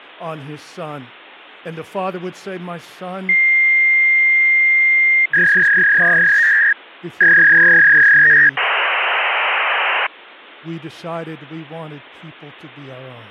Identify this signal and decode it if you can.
Fax machine handshake, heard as a long tone, a warble and hiss, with speech in English.